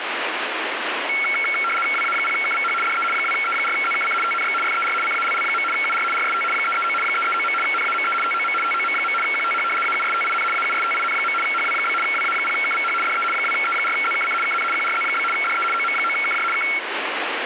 RTTY (75 baud, 850 Hz shift), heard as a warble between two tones, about 1800 Hz centre, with radio static. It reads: WA0KVH DE 2E4ZKC TNX FER CALL. UR RST 339 339. NAME TOM TOM. QTH AUSTIN AUSTIN. HW? WA0KVH DE 2E4ZKC KN QRZ? DE OM9KJ K